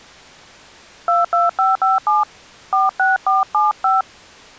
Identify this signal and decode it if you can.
DTMF, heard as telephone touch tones, dialled by hand, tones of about 170 ms. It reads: 22557 46475